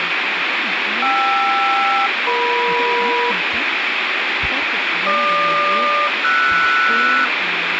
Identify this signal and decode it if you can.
Aircraft SELCAL, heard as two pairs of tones, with radio static and speech in French. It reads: KR-EM GQ-RS